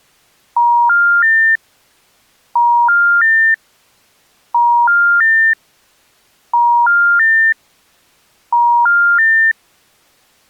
Telephone call progress tone (ITU plan), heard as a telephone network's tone, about 950, 1400, 1800 Hz. Special information tone.